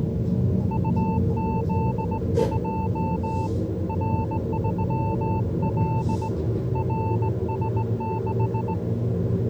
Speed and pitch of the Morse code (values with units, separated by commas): 18 wpm, 890 Hz